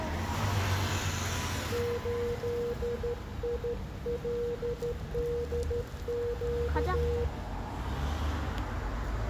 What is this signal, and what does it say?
Morse code, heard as a keyed tone, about 13 wpm, 480 Hz, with room echo and street noise. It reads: 8ILDQ